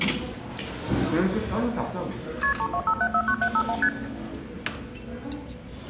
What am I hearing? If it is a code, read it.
Multi-frequency trunk signalling (R1, as on North American trunks), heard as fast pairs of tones, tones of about 70 ms, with room echo and the noise of a restaurant. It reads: KP 325749751 ST